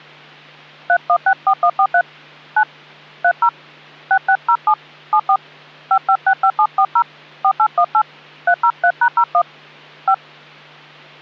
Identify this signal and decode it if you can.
DTMF, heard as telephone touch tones, dialled by hand, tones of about 70 ms, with hum. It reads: 3164143 9 30 6607 74 5565740 4818 303#01 5